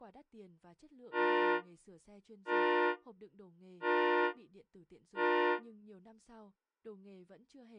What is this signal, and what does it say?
Train horn signal, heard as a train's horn, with speech in Vietnamese. 4 short. On North American railways: a request for a signal to be given or repeated.